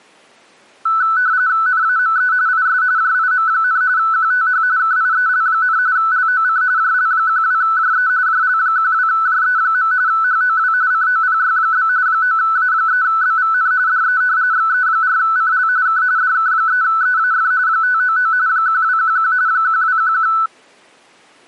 RTTY (45.45 baud, 170 Hz shift), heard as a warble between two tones, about 1410 Hz centre. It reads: NAME IS JIM, QTH KIEL, LOC JL12JE JL12JE. HOW COPY? 9A3BVN DE XE4CL K DK3EAF 599 1211 1211